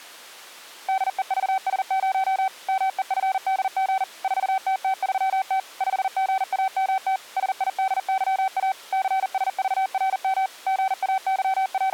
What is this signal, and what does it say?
Morse code, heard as a keyed tone, machine-sent, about 40 wpm, 770 Hz. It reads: DEVS0 MEFDG 4TT3T 5GAMT SIDYA CSVRM …